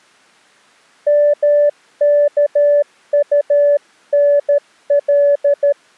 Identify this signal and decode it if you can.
Morse code, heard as a keyed tone, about 13 wpm, 580 Hz. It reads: MKUNL